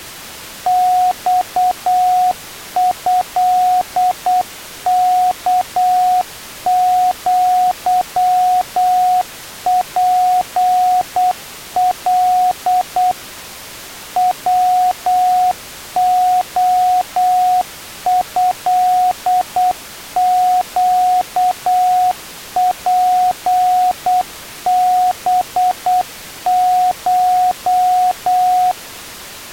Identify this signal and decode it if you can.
Morse code (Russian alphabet), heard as a keyed tone, machine-sent, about 8 wpm, 730 Hz. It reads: ЬЭКЪПЛ ВОЭЩПБШ